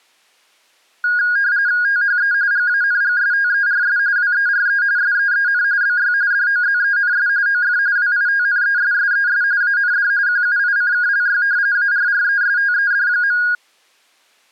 RTTY (45.45 baud, 170 Hz shift), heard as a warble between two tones, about 1550 Hz centre. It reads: THE GANGSTERS WERE SEEN BY DOZENS OF WITNESSES AND QUICKLY ARRESTED.